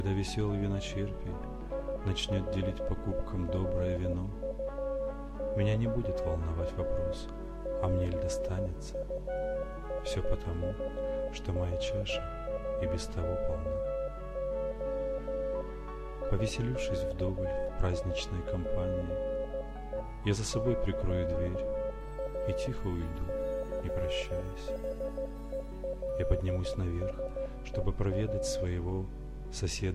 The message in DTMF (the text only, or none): none